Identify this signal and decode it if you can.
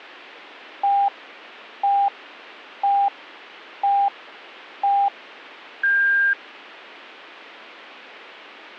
Radio time signal (five pips and a higher one, as on Chinese radio), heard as pips.